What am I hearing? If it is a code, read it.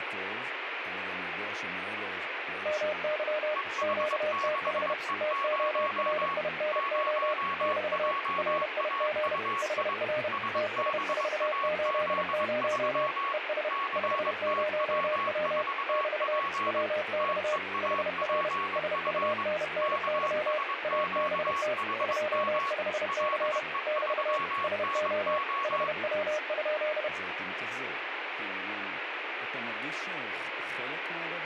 Morse code, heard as two keyed tones, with radio static and speech in Hebrew. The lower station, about 31 wpm, 610 Hz: MY QTH TORINO <BT> RIG HR TS480 ES 50W <BT> WX HR SUNNY ABT 25C <BT> SO HW?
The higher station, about 22 wpm, 1110 Hz: EH6E0 0JAUI SBAZ3 CTW4P TEAPF KSQHM LE3NO